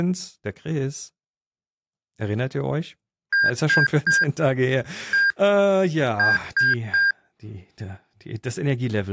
Beep code, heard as beeps, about 1600 Hz, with speech in German. 3-1-3. In Phoenix BIOS tables: interrupt mask register failure.